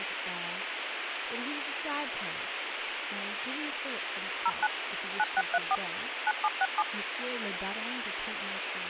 DTMF, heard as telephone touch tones, dialled by machine, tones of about 40 ms, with radio hiss and speech in English. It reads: 09 9634 9767